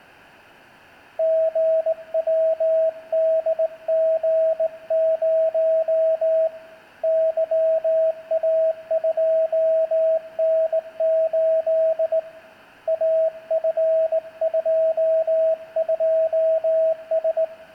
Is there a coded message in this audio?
Yes: Morse code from 1.1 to 17.5 s, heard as a keyed tone, hand-sent with a straight key, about 19 wpm, 640 Hz, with room echo. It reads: GWDG0 YA2N8 AF22S